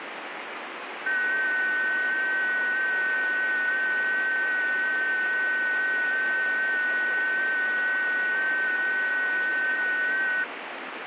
FT8 (several signals at once), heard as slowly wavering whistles, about 6.25 baud, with radio static.